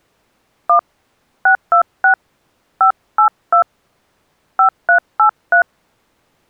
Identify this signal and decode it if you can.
DTMF, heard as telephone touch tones, dialled by hand, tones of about 100 ms. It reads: 1 626 582 5383